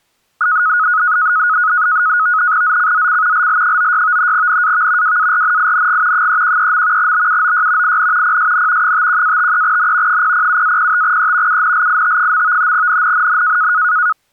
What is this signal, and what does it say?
NAVTEX (SITOR-B), 100 baud, 170 Hz shift, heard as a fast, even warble, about 1360 Hz centre. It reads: ZCZC LL96 NAV WARNING 313. BUOY IN PSN 51-53N 007-05E UNLIT. NNNN